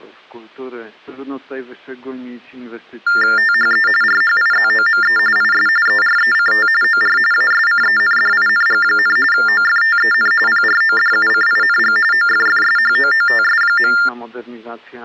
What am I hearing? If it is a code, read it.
TTY/TDD text telephone tones (45.45 baud Baudot), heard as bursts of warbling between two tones, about 400 Hz shift, 1600 Hz centre. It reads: THE RHIZOME IS ERECT OR ASCENDING, OFTEN PRODUCING OFFSHOOTS.